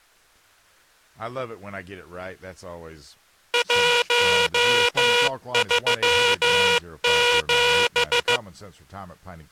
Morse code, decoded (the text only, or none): 137